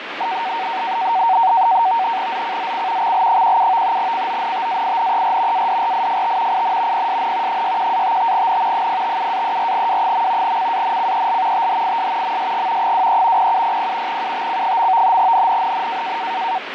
NAVTEX (SITOR-B), 100 baud, 170 Hz shift, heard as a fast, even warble, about 840 Hz centre, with radio static. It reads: ZCZC XL17 CONTAINER ADRIFT IN PSN 61-55N 057-34W. CANCEL THIS MSG 23 0700 UTC. NNNN